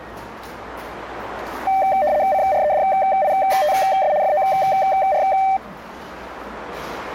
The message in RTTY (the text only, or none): CREDITS FOR